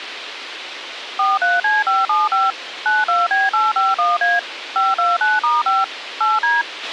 DTMF, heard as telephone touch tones, dialled by machine, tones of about 180 ms, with radio hiss and a squelch burst at the end. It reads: 43C575 92B851A 529*5 8D